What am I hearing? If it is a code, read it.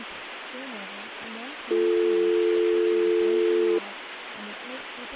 Telephone call progress tone (North American or UK plan), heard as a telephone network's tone, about 350, 440 Hz, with phone line noise and speech in English. Dial tone.